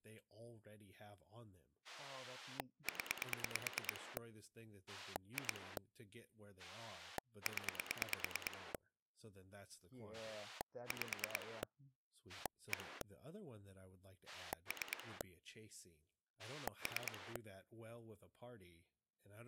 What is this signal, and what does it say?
Pulse dialling, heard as a rotary dial, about 9 pulses a second, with speech in English. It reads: 0 2 0 5 1 3 3